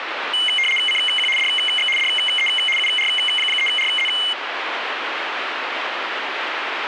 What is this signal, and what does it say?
RTTY (75 baud, 850 Hz shift), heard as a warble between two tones, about 2550 Hz centre, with radio static. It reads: CQ DX DE UR3RZ